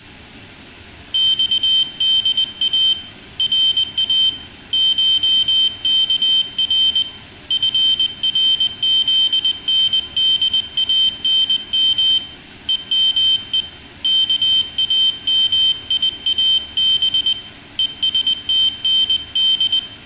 Morse code (Persian alphabet), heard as a high beeper, hand-sent with a paddle, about 20 wpm, 3100 Hz, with room echo. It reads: خدا را شکر فرزندانم همه کامیاب هستند